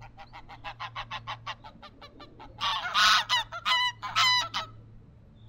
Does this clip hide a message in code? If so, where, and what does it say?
No.